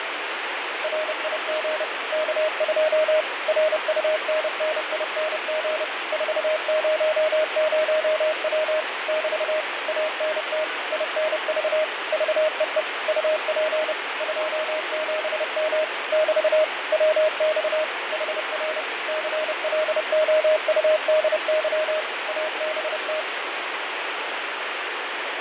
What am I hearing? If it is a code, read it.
Morse code, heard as a keyed tone, machine-sent, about 30 wpm, 620 Hz, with radio static and fading. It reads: RIG K2 RUNNING 400W <BT> ANT INV VEE UP 27M <BT> WX HR CLOUDY ABT